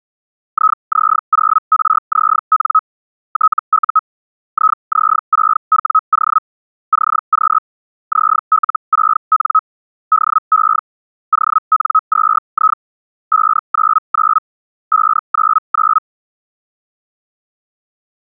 Hellschreiber (Feld-Hell, 122.5 baud), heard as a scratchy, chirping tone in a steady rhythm, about 1280 Hz. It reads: IZ0RZN TU IZ6WO CQ ZL6N DE ON2I 599 599